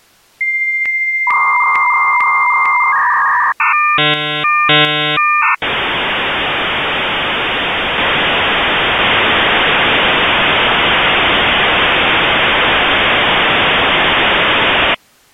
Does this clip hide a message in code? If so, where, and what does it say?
Yes: dial-up modem handshake (V.34 or later) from 0.4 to 14.9 s, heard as a whistle, warbles, then hiss.